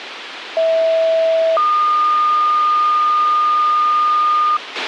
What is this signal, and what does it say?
Two-tone page, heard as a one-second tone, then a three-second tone, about 650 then 1220 Hz, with radio hiss and a squelch burst at the end.